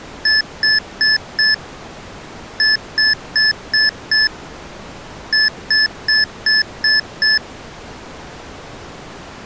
Beep code, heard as beeps from a small speaker, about 1750 Hz. 4-5-6.